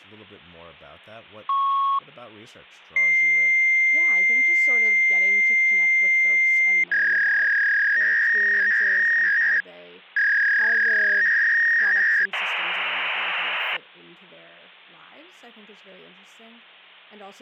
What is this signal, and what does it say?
Fax machine handshake, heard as a beep, a long tone, a warble and hiss, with hum and speech in English.